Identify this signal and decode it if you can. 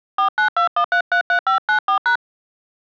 DTMF, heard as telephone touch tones, dialled by hand, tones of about 100 ms. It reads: 4921333594#